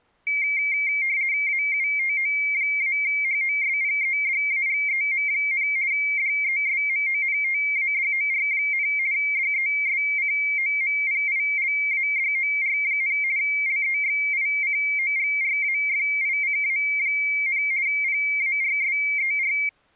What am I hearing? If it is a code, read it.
RTTY (50 baud, 170 Hz shift), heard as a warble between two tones, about 2200 Hz centre. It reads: AUTO-HOSPEDAGEM, DESMONTADOR, DESCOMPILADOR, LEXICOGRAFICA, PARSER